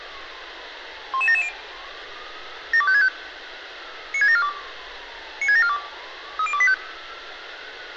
Five-tone selective call (ZVEI), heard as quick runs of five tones, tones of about 70 ms, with radio hiss and street noise. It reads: 11770 72565 96742 96742 30285